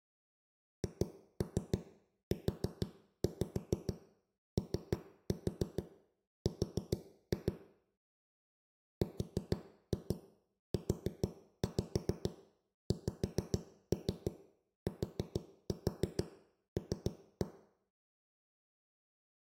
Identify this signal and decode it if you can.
Tap code, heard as knocks on a wall, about 6 knocks a second, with room echo. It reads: HUOR RUXTL